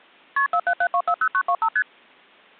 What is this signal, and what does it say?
Multi-frequency trunk signalling (R1, as on North American trunks), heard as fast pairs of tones, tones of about 70 ms. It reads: KP 477240925 ST